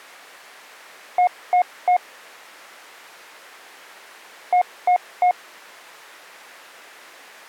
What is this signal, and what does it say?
Beep code, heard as beeps, played twice, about 720 Hz. 3 short. In AMI BIOS tables: failure in the first 64 KB of memory; in Dell tables: chipset error.